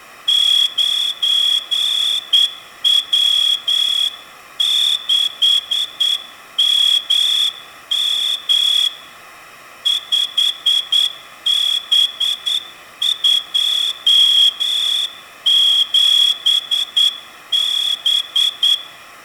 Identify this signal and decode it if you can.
Morse code, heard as a whistle, hand-sent with a straight key, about 9 wpm, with room echo. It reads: 9W6MM 5B27B